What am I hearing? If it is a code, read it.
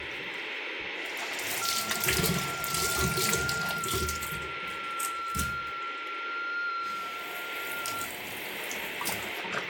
FT8 (one signal), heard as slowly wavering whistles, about 6.25 baud, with radio static and the noise of a restroom.